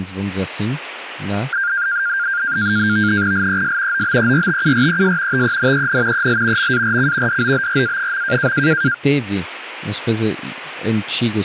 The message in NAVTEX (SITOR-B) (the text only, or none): LES OBERTURES TENEN EL MARC DOBRA.